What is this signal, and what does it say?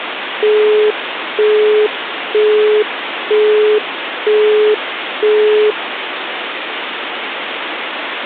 Telephone call progress tone (single-tone plan, as in Europe, Japan and elsewhere), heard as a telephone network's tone, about 420 Hz, 0.48 s on and 0.48 s off, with phone line noise. Busy tone.